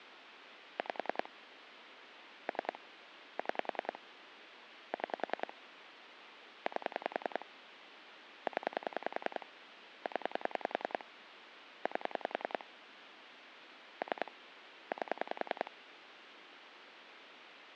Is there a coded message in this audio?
Yes: pulse dialling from 0.8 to 15.7 s, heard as clicks on a phone line, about 10 pulses a second, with phone line noise. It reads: 5 3 6 6 8 0 0 8 3 8